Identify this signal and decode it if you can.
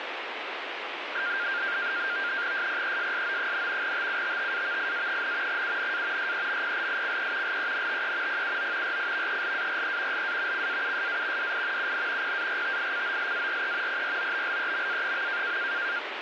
NAVTEX (SITOR-B), 100 baud, 170 Hz shift, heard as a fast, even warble, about 1500 Hz centre, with radio static. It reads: SPESSO, TUTTAVIA, UNA SEMPLICE LENTE PUO RIVELARE LA CAUSA DI UN PARTICOLARE PROBLEMA.